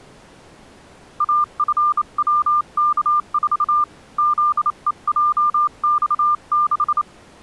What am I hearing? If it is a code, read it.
Morse code, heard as a keyed tone, hand-sent with a bug key, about 28 wpm, 1200 Hz. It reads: AFWK4 ZEJX6